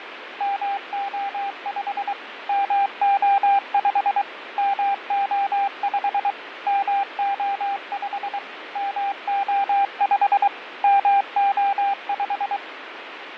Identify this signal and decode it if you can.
Morse code, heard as a keyed tone, machine-sent, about 23 wpm, 800 Hz, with radio static and fading. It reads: MO5 MO5 MO5 MO5 MO5 MO5